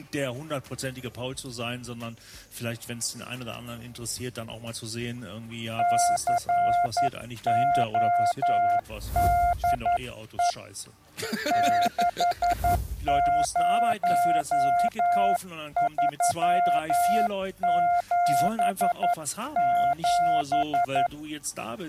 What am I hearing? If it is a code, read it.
Morse code, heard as a keyed tone, hand-sent with a paddle, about 11 wpm, 700 Hz. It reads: CODE 60377